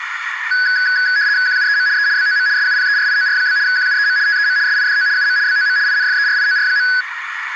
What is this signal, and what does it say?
RTTY (75 baud, 170 Hz shift), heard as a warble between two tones, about 1600 Hz centre, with radio static and a narrow filter. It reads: QUEM E BOM SUPERIOR? QUEM TEM SIDO UM BOM INFERIOR.